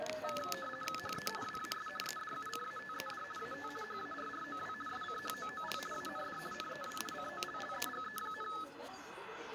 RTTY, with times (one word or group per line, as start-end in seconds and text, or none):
1.0-1.3 HE
1.4-1.9 WAS
2.0-3.2 EDUCATED
3.4-3.7 AT
3.8-4.7 HARROW
4.9-5.8 SCHOOL
5.9-6.4 AND
6.5-7.0 NEW
7.1-8.5 COLLEGE,